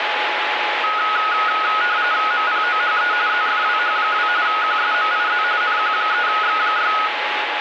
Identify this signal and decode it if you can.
RTTY (45.45 baud, 170 Hz shift), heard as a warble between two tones, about 1360 Hz centre, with radio static and a steady whistle near 840 Hz. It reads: MPOHE ZFWH2 QSMIZ NQ3X6